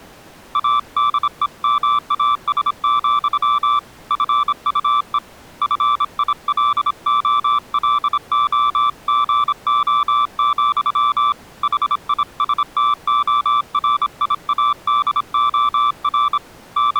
Morse code, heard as a keyed tone, hand-sent with a bug key, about 26 wpm, 1170 Hz. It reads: ADEMAS, FUE FILOLOGO, HISTORIADOR …